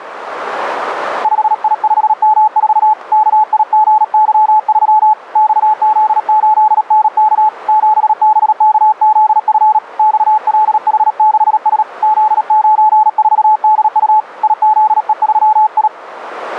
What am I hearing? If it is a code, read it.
Morse code, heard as a keyed tone, hand-sent with a paddle, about 37 wpm, 860 Hz, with radio static. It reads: 5I5M4 KIGY3 XZ8NK 7BKZF XLH6S Z94DU IZE3I